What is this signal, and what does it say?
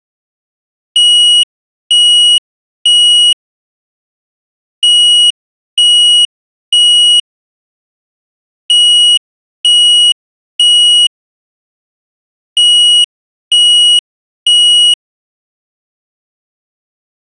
Alarm pattern, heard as an alarm's beeps, played four times, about 2900 Hz. Temporal three. Smoke or fire, evacuate.